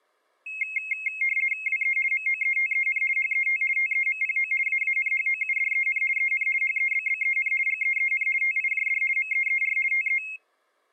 RTTY (50 baud, 450 Hz shift), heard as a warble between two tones, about 2350 Hz centre. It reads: WE MOETEN HET TEMPO AANHOUDEN EN HEBBEN GEEN TIJD MEER TE